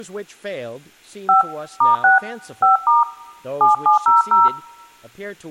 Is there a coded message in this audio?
Yes: DTMF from 1.3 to 4.5 s, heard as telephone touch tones, dialled by hand, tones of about 150 ms, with speech in English. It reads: 5 *6 5* 7700